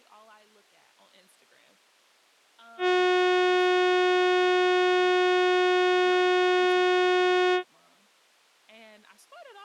Ship horn signal, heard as a ship's horn, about 360 Hz, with speech in English. 1 long. At sea: a vessel nearing a blind bend, or under power and making way in fog.